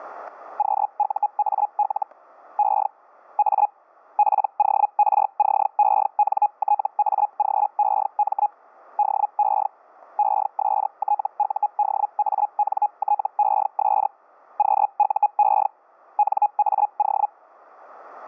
Hellschreiber (Feld-Hell, 122.5 baud), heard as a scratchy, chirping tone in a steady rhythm, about 830 Hz, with static crashes. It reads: QUAL E A PORCENTAGEM DE ESTUDANTES QUE NAO